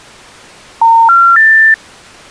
Telephone call progress tone (North American plan), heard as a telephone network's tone, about 910, 1370, 1800 Hz. Special information tone.